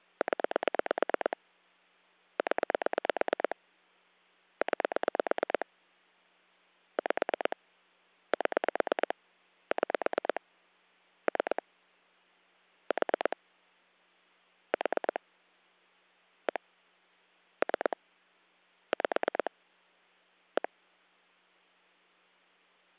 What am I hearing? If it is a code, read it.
Pulse dialling, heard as clicks on a phone line, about 9 pulses a second. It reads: 0 0 9 5 7 6 3 4 4 1 3 5 1